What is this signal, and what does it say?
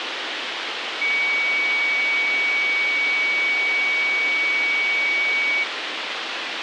A steady tone, with radio hiss. There is no code.